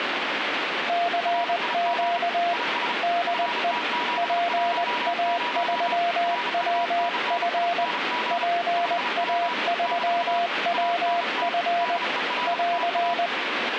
Morse code, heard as two keyed tones, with radio static. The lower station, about 20 wpm, 690 Hz: CQ DE PA3WF PA3WF <AR>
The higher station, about 35 wpm, 970 Hz: RIG IS FT710 RUNNING 5W - ANT DELTA